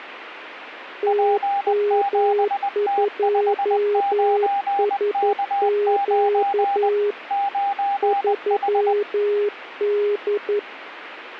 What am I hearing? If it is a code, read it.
Morse code, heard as two keyed tones, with radio static. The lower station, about 11 wpm, 410 Hz: TM2SQ 3D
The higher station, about 20 wpm, 800 Hz: P7T59K9 9H